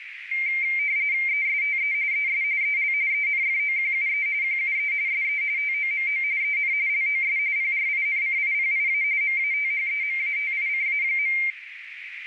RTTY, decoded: ESTE ES EL ENFOQUE QUE SE TOMO EN LOS PRINCIPIA MATHEMATICA.

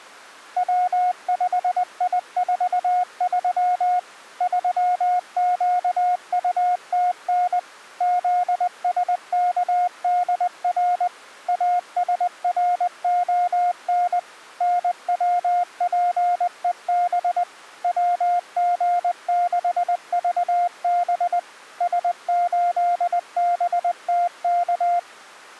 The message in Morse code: W5I43 3QUTN ZSKDR ASRON NWPEB WG6VB S8BTK

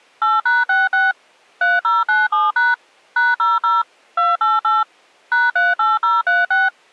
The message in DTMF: 8#66 3097# #00 288 #38036

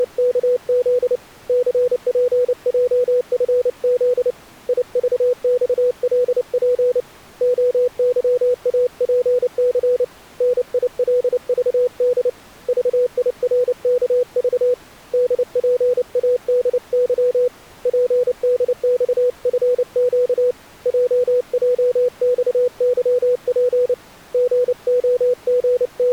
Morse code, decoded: … CPJFZ IVXLP OYAPC NILVD VIRKV DPADY PDXFQ JJXYP …

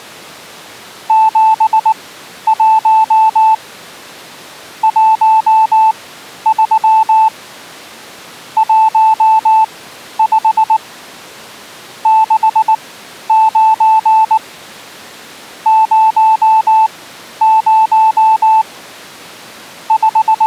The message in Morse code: 71 13 15 69 00 …

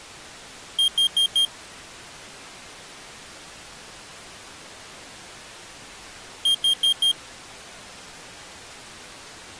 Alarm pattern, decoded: temporal four

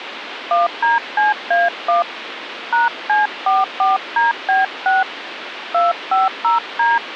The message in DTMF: 1DCA1 #C44DB6 250D

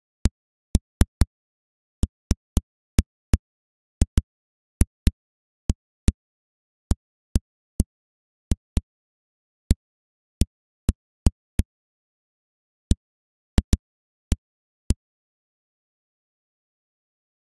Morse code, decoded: none

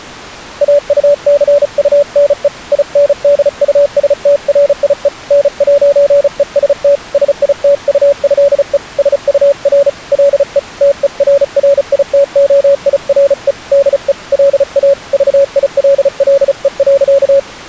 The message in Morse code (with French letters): AUCUNE INDUSTRIE N'EST SITUÉE SUR LE TERRITOIRE DE LA VILLE.

